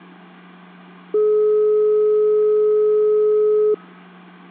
Telephone call progress tone (425 Hz plan, as in most of Europe), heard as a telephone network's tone, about 420 Hz, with hum and room echo. Dial tone.